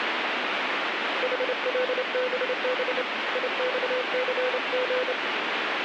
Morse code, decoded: HLBB IXCG

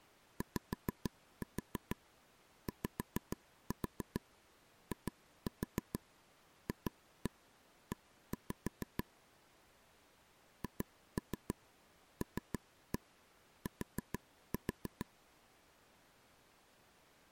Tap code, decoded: YYIFE HLT

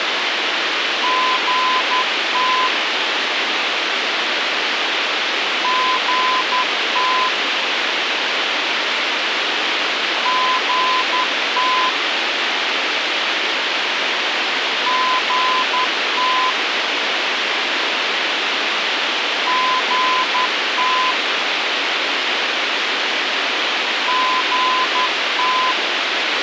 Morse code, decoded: GT GT GT GT GT GT

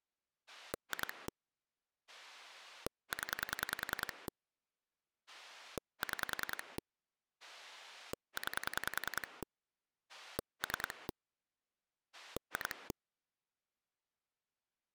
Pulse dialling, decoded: 2 0 6 9 3 2

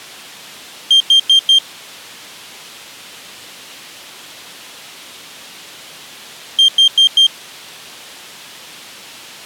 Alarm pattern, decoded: temporal four

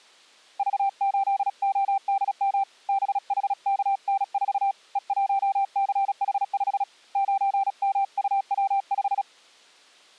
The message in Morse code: V8ODM BHKN4 E1CH5 9MUW5

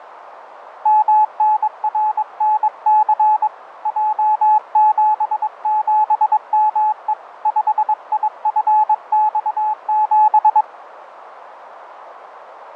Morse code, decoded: MNRNC J77ME 5IFX7

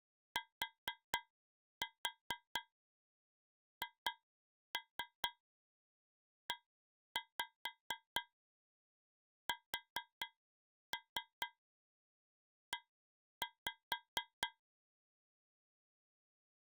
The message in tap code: THESE

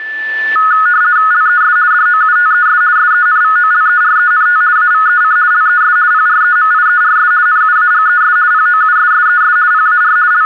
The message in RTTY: LES DOUTES SENVOLERENT AVEC LES PREMIERS NUAGES POUSSES PAR …

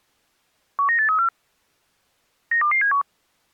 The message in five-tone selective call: 19834 92271

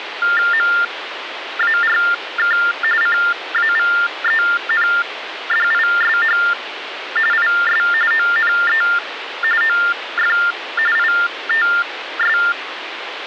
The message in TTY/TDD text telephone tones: MARK CAVENDISH IS ONE OF ITS

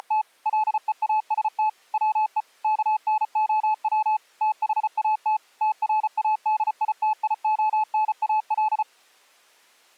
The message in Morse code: … LEAST WE KNOW THAT TRADITIONAL

